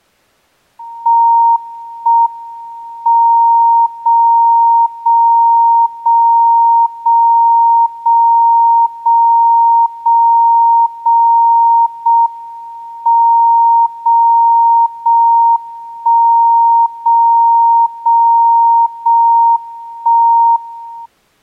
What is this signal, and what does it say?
Radio time signal (JJY), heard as a tone whose level steps once a second, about 930 Hz. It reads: 1 M 0 0 0 0 0 0 0 0 0 M 0 0 1 0 0 0 1 1